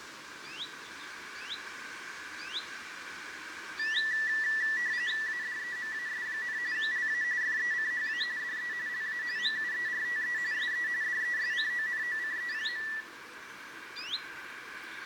RTTY (45.45 baud, 170 Hz shift), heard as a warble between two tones, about 1850 Hz centre, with radio static and room echo. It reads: ADEMAS, LA FECHA DE LA MUERTE SE DESCONOCE.